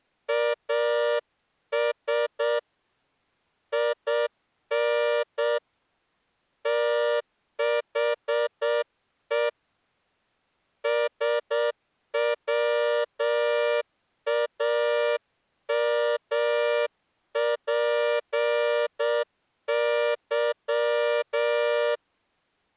Morse code, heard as a horn, hand-sent with a straight key, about 7 wpm. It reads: AS IN THE SWAMPY